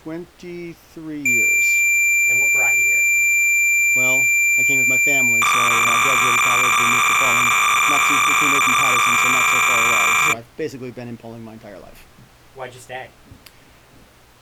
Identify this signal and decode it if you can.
Cassette data (Kansas City type), 300 baud, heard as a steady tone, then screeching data.